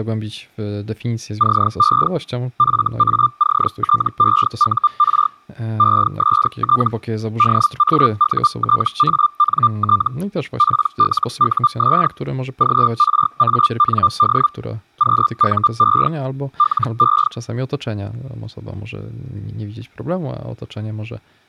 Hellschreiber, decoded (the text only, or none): CE FACTEUR EST DAUTANT PLUS GRAND QUE LE